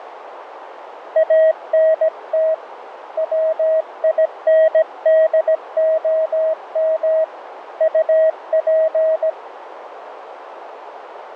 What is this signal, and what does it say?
Morse code, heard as a keyed tone, hand-sent with a paddle, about 17 wpm, 640 Hz, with radio static and a narrow filter. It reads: ANT WINDOM UP